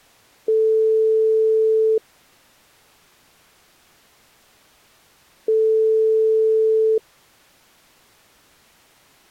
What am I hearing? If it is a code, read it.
Telephone call progress tone (single-tone plan, as in most of Europe), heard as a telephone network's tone, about 440 Hz, 1.5 s on and 3.5 s off. Ringback tone.